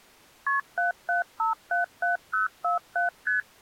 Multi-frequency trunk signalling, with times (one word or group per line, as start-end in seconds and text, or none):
0.5-0.6 KP
0.8-3.1 77577047
3.3-3.4 ST